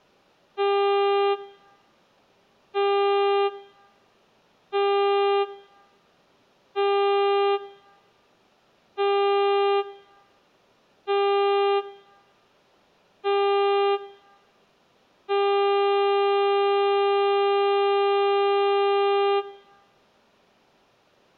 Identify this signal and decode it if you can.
Ship horn signal, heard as a ship's horn, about 400 Hz, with room echo. 7 short, 1 long. At sea: general emergency alarm.